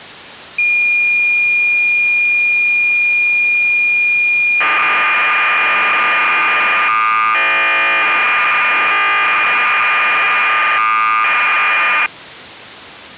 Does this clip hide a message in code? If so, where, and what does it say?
Yes: cassette data (Kansas City type), 1200 baud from 0.6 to 12.1 s, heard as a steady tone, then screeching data.